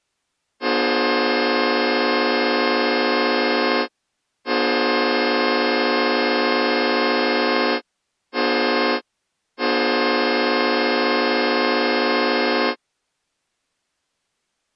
Train horn signal, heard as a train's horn. 2 long, 1 short, 1 long. On North American railways: approaching a public crossing.